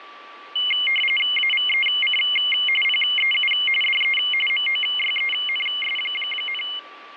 RTTY (45.45 baud, 850 Hz shift), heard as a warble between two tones, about 2550 Hz centre, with radio static, fading and a steady whistle near 1160 Hz. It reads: AVEC PEU DE MOYENS,